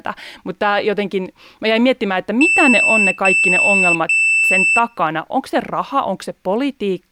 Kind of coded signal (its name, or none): beep code